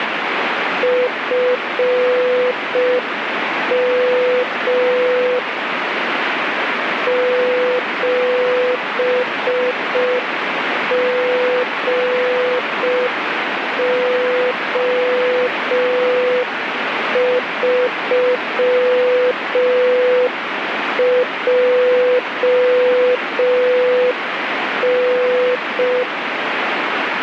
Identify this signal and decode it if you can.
Morse code, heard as a keyed tone, machine-sent, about 5 wpm, 500 Hz, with radio static. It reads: FM 7GO3JN